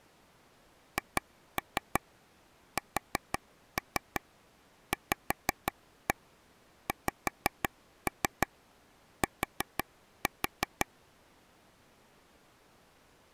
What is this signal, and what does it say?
Tap code, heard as taps on a table, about 5 knocks a second. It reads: HSVXT